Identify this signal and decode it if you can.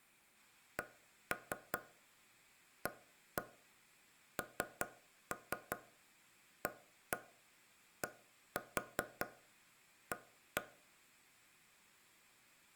Tap code, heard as taps on a table, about 5 knocks a second, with room echo. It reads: CANADA